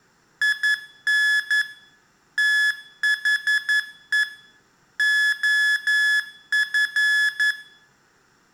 Morse code, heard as electronic beeps, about 11 wpm, 1700 Hz, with room echo. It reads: IN THE OF